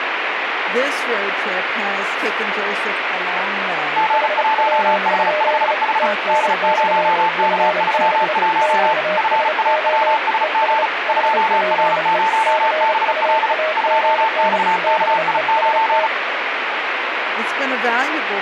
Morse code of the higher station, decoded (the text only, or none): G1H5H D0K31 FAWSG 2R0BL 2XKI9